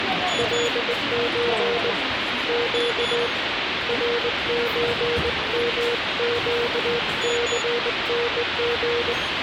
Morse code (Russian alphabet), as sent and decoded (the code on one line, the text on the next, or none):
.-.. ---. / --.- / .-. ---. -- --.- -.-. -. --.
ЛЧ Щ РЧМЩЦНГ